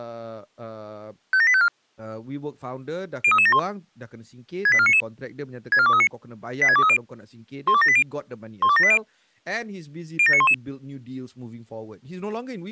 Five-tone selective call (ZVEI), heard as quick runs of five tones, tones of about 70 ms, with speech in Malay. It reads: 57854 03371 68499 64239 86230 12780 12780 07911